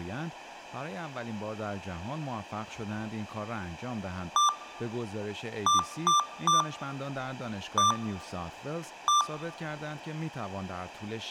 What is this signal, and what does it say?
Beep code, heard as beeps from a small speaker, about 1180 Hz, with room echo and speech in Persian. 1-3-1-1. In Phoenix BIOS tables: memory refresh test failure.